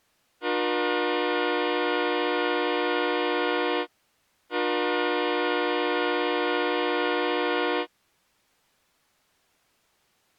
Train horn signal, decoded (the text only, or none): 2 long